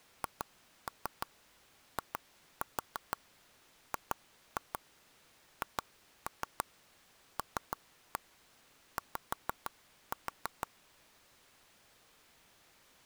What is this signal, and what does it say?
Tap code, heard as taps on a table, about 6 knocks a second. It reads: HIGHLY